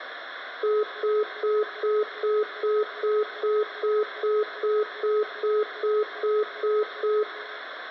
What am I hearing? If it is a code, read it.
Telephone call progress tone (single-tone plan, as in most of Europe), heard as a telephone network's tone, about 420 Hz, 0.2 s on and 0.2 s off, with room echo. Congestion tone.